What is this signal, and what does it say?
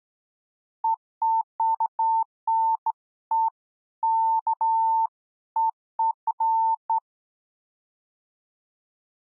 Beeps of irregular length. There is no code.